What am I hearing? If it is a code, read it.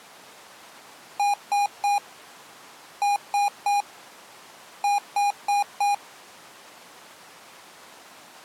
Beep code, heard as beeps from a small speaker, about 810 Hz. 3-3-4. In Phoenix BIOS tables: video failure.